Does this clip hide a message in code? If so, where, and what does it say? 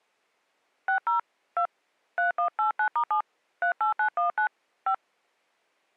Yes: DTMF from 0.9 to 4.9 s, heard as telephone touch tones, dialled by hand, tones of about 100 ms. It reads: 60 2 3189*7 38919 5